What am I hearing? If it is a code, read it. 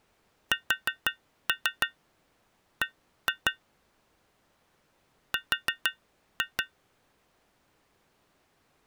Tap code, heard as taps on glass, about 6 knocks a second. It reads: SB R